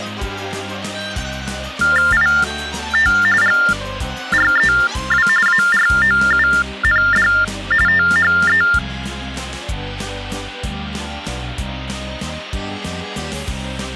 TTY/TDD text telephone tones (45.45 baud Baudot), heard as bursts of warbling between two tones, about 400 Hz shift, 1600 Hz centre. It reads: IT GREW AROUND THE